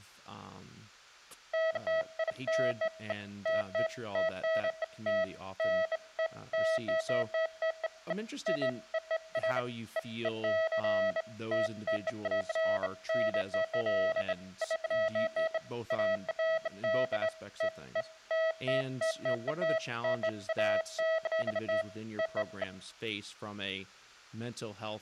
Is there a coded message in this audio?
No, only beeps of irregular length, with speech in English.